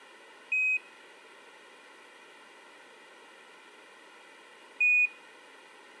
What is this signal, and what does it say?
Quindar tones, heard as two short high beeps, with room echo.